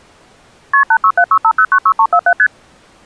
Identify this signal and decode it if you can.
Multi-frequency trunk signalling (R1, as on North American trunks), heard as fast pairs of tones, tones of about 70 ms. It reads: KP 86765096347 ST